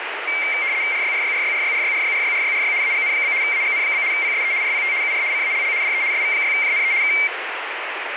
RTTY (75 baud, 170 Hz shift), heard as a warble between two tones, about 2200 Hz centre, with radio static. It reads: RYRYRYRYRYRYRYRYRY AGN? AGN? PSE RPT UR CALL DE SV6JNE K